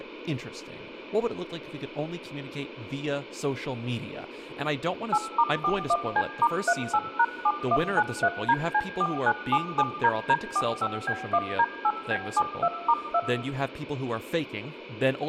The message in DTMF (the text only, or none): 8*41C*38#7193DC4977DD45B1D8B72*2